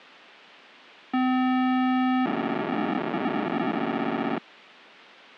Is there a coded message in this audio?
Yes: POCSAG pager data (512 baud) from 1.1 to 4.4 s, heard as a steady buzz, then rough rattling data, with a squelch burst at the end.